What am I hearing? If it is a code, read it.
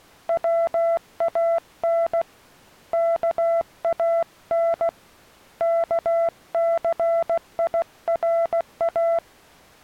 Morse code (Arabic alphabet), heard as a keyed tone, hand-sent with a paddle, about 16 wpm, 670 Hz. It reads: وان كان كثيرا